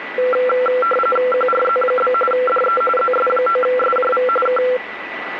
RTTY (45.45 baud, 850 Hz shift), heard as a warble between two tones, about 930 Hz centre, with radio static and a steady whistle near 1970 Hz. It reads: QRZ? DE ZS9SJV K